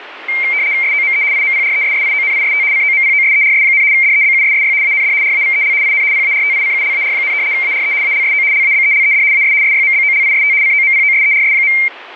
RTTY (75 baud, 170 Hz shift), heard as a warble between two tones, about 2200 Hz centre, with radio static. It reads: SOME IMPRESSIONIST COMPOSERS, DEBUSSY AND RAVEL IN PARTICULAR, ARE ALSO LABELED AS SYMBOLIST COMPOSERS.